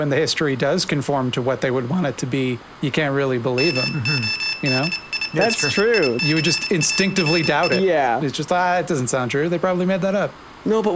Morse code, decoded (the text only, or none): MODIFICARI